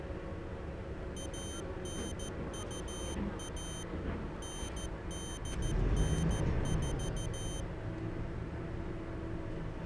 Morse code (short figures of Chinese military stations), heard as a high beeper, machine-sent, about 14 wpm, 3100 Hz, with the noise inside a bus. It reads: 1921 9894